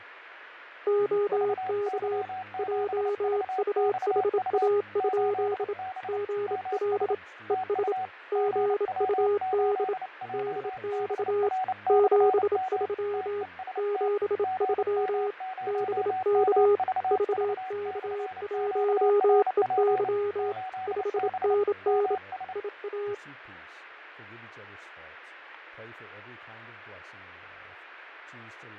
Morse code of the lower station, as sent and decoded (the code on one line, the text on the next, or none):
--- -.- / .--- ..- .... .- ..--.. / --. .-.. / . ... / --. ..- -.. / -.. -..- / --... ...-- / --... ...-- / -... -.- / ...- -.- .---- . -.-- / ..... -. -. / .. .-
OK JUHA? GL ES GUD DX 73 73 BK VK1EY 5NN IA